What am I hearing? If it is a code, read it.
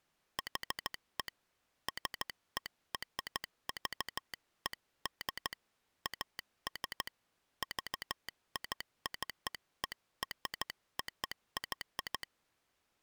Morse code (American railroad code), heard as a telegraph sounder, hand-sent with a straight key. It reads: HE SERVED AS VICEROY